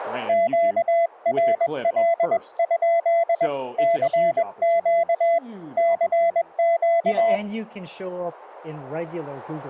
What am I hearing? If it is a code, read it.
Morse code, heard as a keyed tone, hand-sent with a paddle, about 21 wpm, 680 Hz, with speech in English. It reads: QRL? CQ CQ